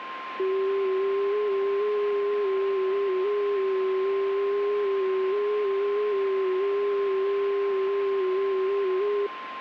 FT8 (one signal), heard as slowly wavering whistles, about 6.25 baud, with radio static and a steady whistle near 1050 Hz.